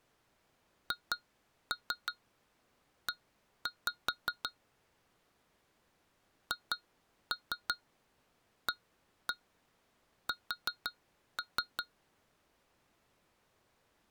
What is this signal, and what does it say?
Tap code, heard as taps on glass, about 5 knocks a second. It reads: HE HAS